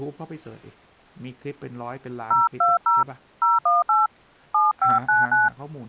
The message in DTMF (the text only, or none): 020 018 7599